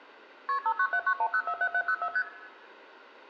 Multi-frequency trunk signalling (R1, as on North American trunks), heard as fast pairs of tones, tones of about 70 ms, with room echo. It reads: KP 59791047704 ST